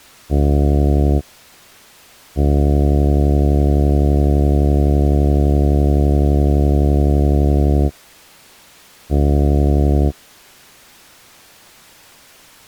Ship horn signal, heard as a ship's horn, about 70 Hz. 1 short, 1 long, 1 short. At sea: a vessel at anchor warns of its position.